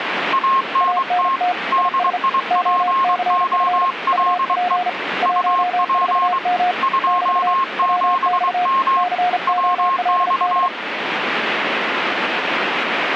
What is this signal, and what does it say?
Morse code, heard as two keyed tones, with radio static. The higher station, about 23 wpm, 1070 Hz: ANT DIPOLE UP 27M WX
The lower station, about 35 wpm, 720 Hz: ANT IS OCF UP 14M <BT> WX COLD